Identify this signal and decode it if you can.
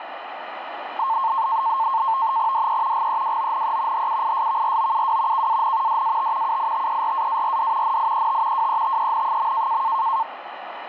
NAVTEX (SITOR-B), 100 baud, 170 Hz shift, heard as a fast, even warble, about 980 Hz centre, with radio static and a steady whistle near 1480 Hz. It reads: DE GEWONE HUISVROUW KAN DAT UITERAARD NIET WETEN.